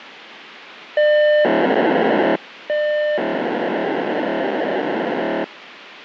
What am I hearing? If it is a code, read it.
POCSAG pager data (1200 baud), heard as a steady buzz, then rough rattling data, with radio hiss.